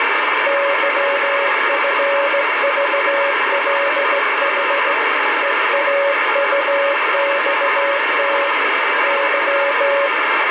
Morse code, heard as a keyed tone, hand-sent with a straight key, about 16 wpm, 560 Hz, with heavy radio static. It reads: YFVLH EAUXT Y